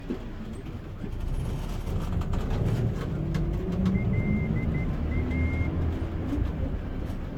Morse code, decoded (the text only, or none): LA